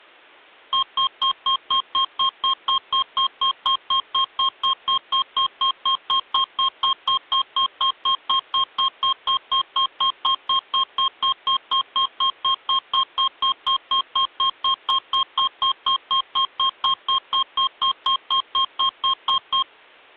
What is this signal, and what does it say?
Evenly repeated beeps. There is no code.